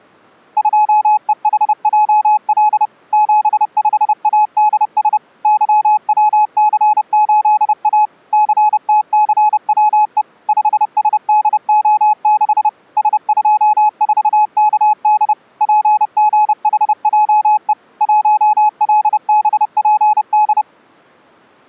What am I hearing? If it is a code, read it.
Morse code, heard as a keyed tone, machine-sent, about 30 wpm, 850 Hz. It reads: 2EHJL 75ADS YWC8A CTCWE 5SDO6 S24KD PGHJE 1LBPD